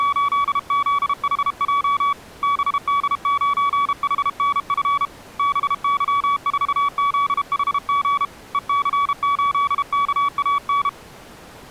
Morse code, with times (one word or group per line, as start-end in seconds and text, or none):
0.0-2.1 …
2.4-5.1 BD9HNF
5.4-8.2 BY4ZHG
8.5-10.9 EC8KAN